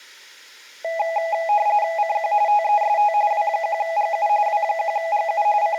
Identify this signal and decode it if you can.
RTTY (45.45 baud, 170 Hz shift), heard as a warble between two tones, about 740 Hz centre. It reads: CQ TEST W1GU W1GU …